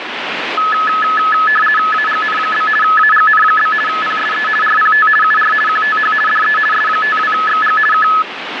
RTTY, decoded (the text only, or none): AGN? AGN? PSE RPT UR QTH DE S52XG K